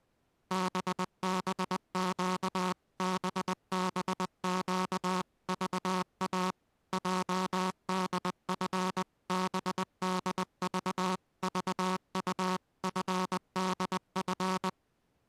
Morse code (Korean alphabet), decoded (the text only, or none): 때때로 흔들리는